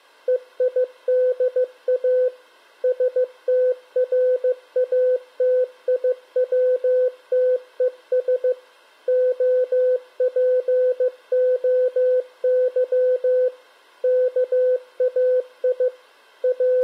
Morse code (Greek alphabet), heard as a keyed tone, machine-sent, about 15 wpm, 510 Hz. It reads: ΕΙΔΑ ΣΤΡΑΤΙΩΤΕΣ ΟΠΟΥ ΚΑΙ …